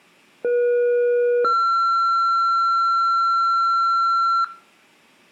Two-tone page, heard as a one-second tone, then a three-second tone, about 480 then 1360 Hz, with room echo.